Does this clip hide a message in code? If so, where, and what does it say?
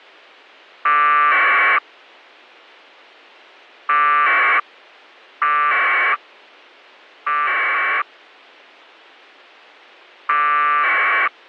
Yes: packet radio (AX.25, as in APRS), 1200 baud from 0.9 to 11.3 s, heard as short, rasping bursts.